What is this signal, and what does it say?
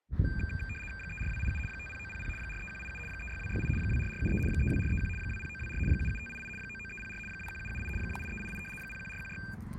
RTTY (75 baud, 850 Hz shift), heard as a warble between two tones, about 2000 Hz centre, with the noise of a residential street. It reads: 34287 50900 43187 36268 24473 32431 20924 77588 99304 21778 28388 01416